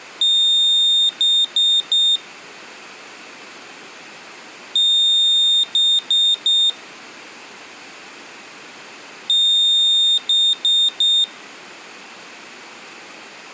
Beep code, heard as a piezo beeper, played three times, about 3650 Hz. 1 long, 3 short. In Award and IBM BIOS tables: video adapter failure; in AMI BIOS tables: memory failure.